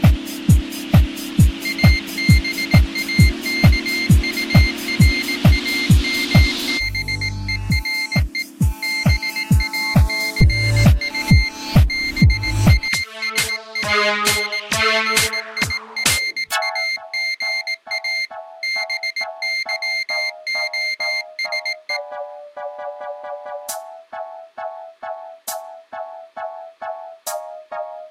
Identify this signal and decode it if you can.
Morse code, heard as a high beeper, hand-sent with a paddle, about 18 wpm, 2100 Hz. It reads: ABAKURAMBERE BACU BASANGIRAGA BYOSE